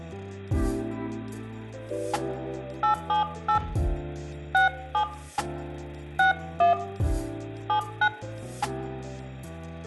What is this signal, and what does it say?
DTMF, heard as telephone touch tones, dialled by hand, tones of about 100 ms, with room echo. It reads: 878 67 61 79